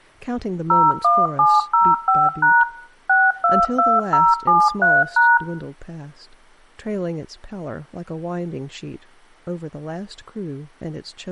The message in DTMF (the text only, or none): 01705# 622073#